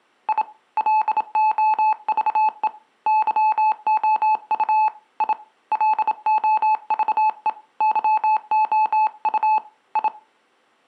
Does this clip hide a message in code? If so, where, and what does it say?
Yes: Morse code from 0.2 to 10.1 s, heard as a keyed tone, hand-sent with a bug key, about 27 wpm, 860 Hz. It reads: I LOVE YOU I LOVE YOU I